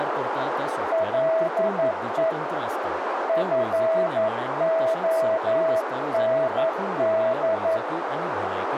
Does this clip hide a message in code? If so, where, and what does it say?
Yes: Morse code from 0.9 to 7.8 s, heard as a keyed tone, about 11 wpm, 650 Hz, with radio static, a narrow filter and speech in Goan Konkani. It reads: LE FOND